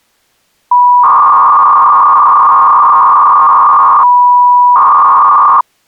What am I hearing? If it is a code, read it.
300-baud modem data (V.21 tones), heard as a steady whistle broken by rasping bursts, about 300 baud, 200 Hz shift.